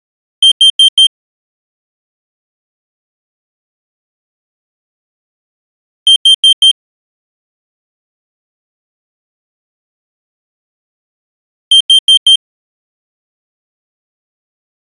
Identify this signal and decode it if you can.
Alarm pattern, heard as an alarm's beeps, played three times, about 3150 Hz. Temporal four. Carbon monoxide.